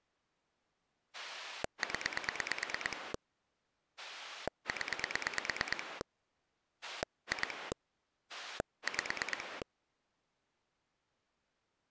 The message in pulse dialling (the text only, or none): 0 0 2 5